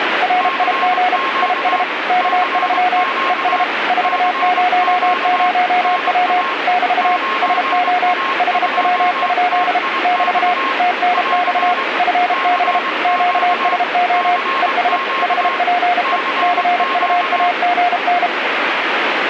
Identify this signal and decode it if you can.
Morse code, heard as two keyed tones, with radio static. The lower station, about 32 wpm, 720 Hz: RIG IS K3 ES 400W <BT> SO HW? <BT> TNX FB QSO ES HPE CUAGN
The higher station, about 23 wpm, 1080 Hz: CQ CQ CQ NA 9A2TIX <AR> CQ CQ CQ